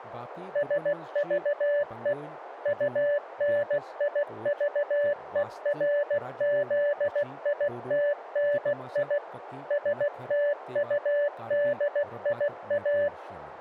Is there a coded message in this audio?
Yes: Morse code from 0.5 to 13.1 s, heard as a keyed tone, machine-sent, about 16 wpm, 580 Hz, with radio static and speech in Kashmiri. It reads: SVE UNIVERZITNI STUDIA